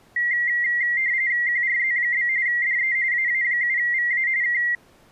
RTTY (45.45 baud, 170 Hz shift), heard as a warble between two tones, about 2000 Hz centre. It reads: QRZ? DE AA7VA K